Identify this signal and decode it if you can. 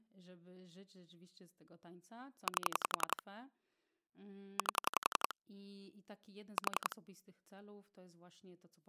Pulse dialling, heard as clicks on a phone line, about 11 pulses a second, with speech in Polish. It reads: 8 8 4